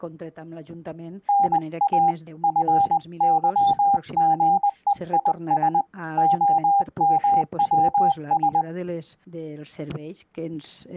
Morse code (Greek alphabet), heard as a keyed tone, hand-sent with a paddle, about 20 wpm, 800 Hz. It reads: ΝΑ ΦΥΓΕΙΣ ΟΜΩΣ